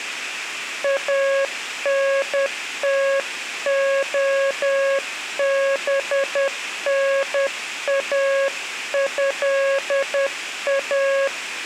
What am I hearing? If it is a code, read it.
Morse code (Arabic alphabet), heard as a keyed tone, hand-sent with a paddle, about 10 wpm, 550 Hz. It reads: انتخبناها